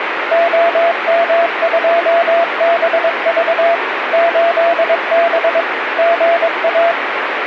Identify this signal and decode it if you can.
Morse code, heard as a keyed tone, machine-sent, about 22 wpm, 680 Hz, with radio static. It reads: OM2BV 8B GA